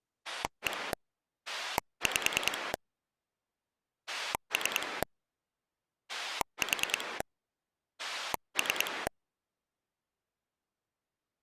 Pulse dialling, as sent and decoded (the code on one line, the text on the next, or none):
1 / 5 / 3 / 4 / 3
1 5 3 4 3